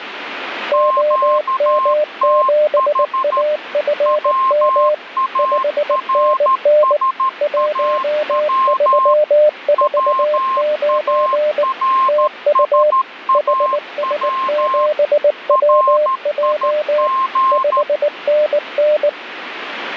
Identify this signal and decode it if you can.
Morse code, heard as two keyed tones, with radio static. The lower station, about 19 wpm, 600 Hz: OM7AFM 5NN 1349 TU HS7WJ 5NN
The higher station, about 13 wpm, 1060 Hz: QTH WARSAW WARSAW RIG